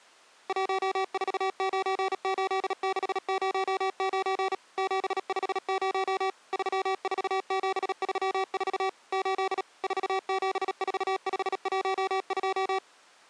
Morse code, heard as electronic beeps, machine-sent, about 37 wpm, 380 Hz. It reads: 1498609 750 34734 8 474512